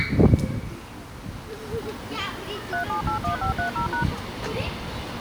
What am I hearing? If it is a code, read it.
DTMF, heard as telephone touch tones, dialled by machine, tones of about 110 ms, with the noise of a park. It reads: 3781530#